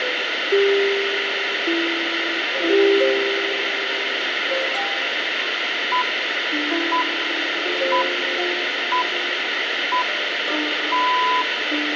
Radio time signal (six pips, as the Greenwich Time Signal), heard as pips, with radio hiss and room echo.